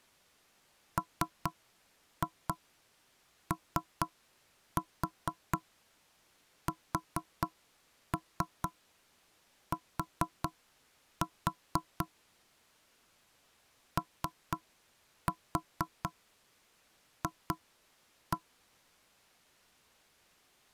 Tap code, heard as knocks on wood, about 4 knocks a second. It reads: MOST OF